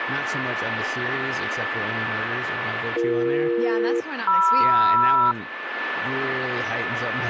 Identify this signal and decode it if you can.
Aircraft SELCAL, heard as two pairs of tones, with radio static, a steady whistle near 1750 Hz and speech in English. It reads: BE-MR